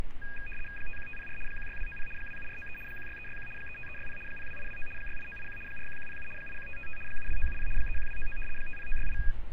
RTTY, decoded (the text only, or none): 51504 16290 27493 16361 35360 02829 68981 41107 81555 72970 31299 50968